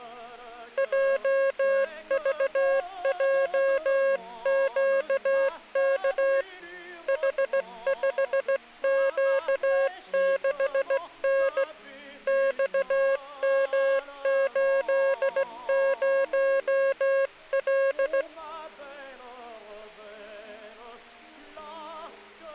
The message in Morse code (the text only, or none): JVJQK H5Q6N XM80L